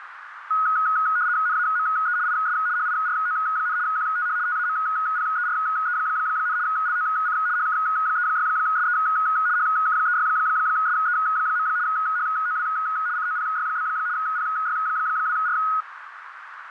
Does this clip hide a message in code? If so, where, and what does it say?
Yes: RTTY (75 baud, 170 Hz shift) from 0.5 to 15.8 s, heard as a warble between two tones, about 1360 Hz centre, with radio static and a narrow filter. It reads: NAME IS HIRO, QTH TAMPERE, LOC HK36SE HK36SE. HOW COPY? PY2R